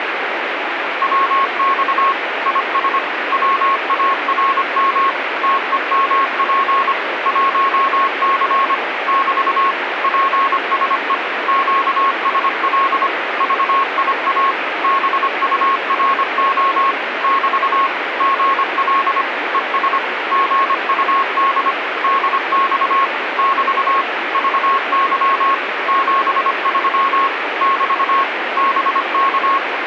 Morse code, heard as a keyed tone, machine-sent, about 25 wpm, 1090 Hz, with radio static. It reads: WX IS WARM TEMP 1C <BT> PSE QSL VIA BURO <BT> GL ES GUD DX <BT> VY 73 <BT> BK